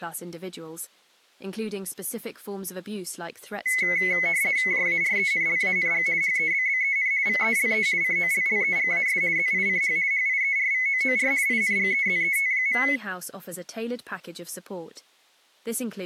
RTTY (50 baud, 170 Hz shift), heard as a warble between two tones, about 2100 Hz centre. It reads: JARENLANG HEBBEN VELE COLLEGAS ZICH HIERVOOR INGEZET.